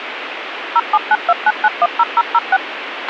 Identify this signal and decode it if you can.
DTMF, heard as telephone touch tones, dialled by machine, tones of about 40 ms, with radio hiss and a squelch burst at the end. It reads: 07929910006